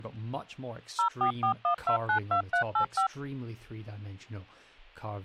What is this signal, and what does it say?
DTMF, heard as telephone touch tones, dialled by machine, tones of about 100 ms, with speech in English. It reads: 0441292385